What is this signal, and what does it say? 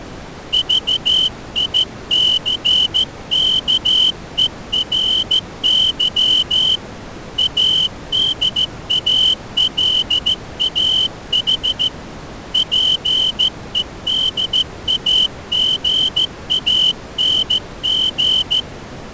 Morse code, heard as a whistle, hand-sent with a straight key, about 14 wpm. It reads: VICKERY ADALAH PEDAGANG